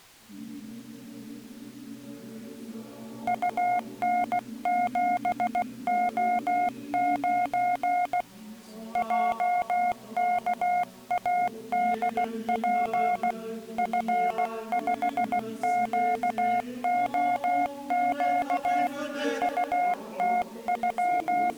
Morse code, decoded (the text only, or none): UN7O9 JKADP F5QOQ …